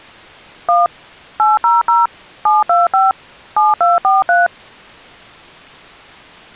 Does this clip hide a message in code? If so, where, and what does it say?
Yes: DTMF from 0.7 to 4.5 s, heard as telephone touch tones, dialled by machine, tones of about 170 ms. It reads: 1 800 725 7243